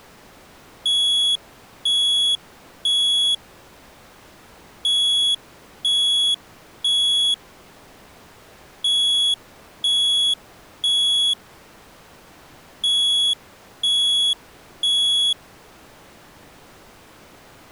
Alarm pattern, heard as an alarm's beeps, played four times, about 3350 Hz. Temporal three. Smoke or fire, evacuate.